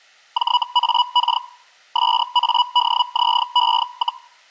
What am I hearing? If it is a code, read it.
Hellschreiber (Feld-Hell, 122.5 baud), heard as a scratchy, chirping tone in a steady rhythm, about 980 Hz. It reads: JAK SADZE,